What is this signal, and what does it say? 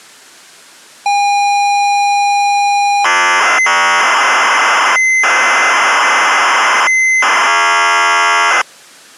ZX Spectrum tape loading, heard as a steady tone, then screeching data.